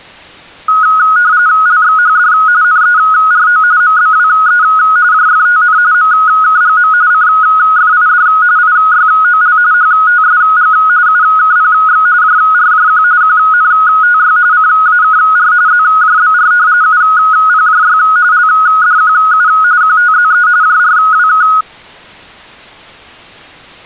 RTTY (45.45 baud, 170 Hz shift), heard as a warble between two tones, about 1360 Hz centre. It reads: LXHD NERO MBWE JFTN MKGM CFID IYOL HTSG UKPX JRJQ QNTY CAKR ZJBR UPJY LDQU QTZE JRWK